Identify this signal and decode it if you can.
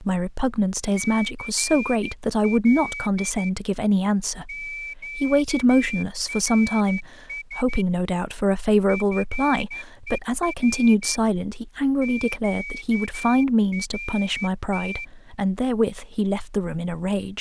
Morse code, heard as a whistle, hand-sent with a straight key, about 12 wpm, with speech in English. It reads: CL QRS FER QRT